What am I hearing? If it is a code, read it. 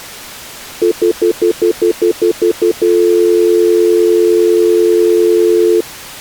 Telephone call progress tone (North American plan), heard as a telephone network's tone, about 350, 440 Hz, 0.1 s on and 0.1 s off. Stutter dial tone.